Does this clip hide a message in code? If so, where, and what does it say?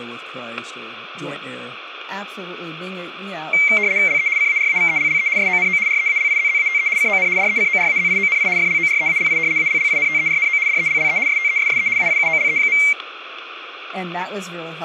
Yes: RTTY (75 baud, 170 Hz shift) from 3.5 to 12.9 s, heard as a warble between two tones, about 2200 Hz centre, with static crashes and speech in English. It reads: LE CARAVELLE SONO REALIZZATE CON DECORAZIONI FLOREALI ALLINTERNO DELLE STESSE AIUOLE.